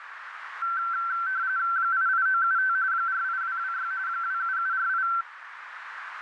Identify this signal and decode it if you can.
RTTY (45.45 baud, 170 Hz shift), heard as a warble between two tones, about 1450 Hz centre, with radio static and a narrow filter. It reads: 88975 48226 27748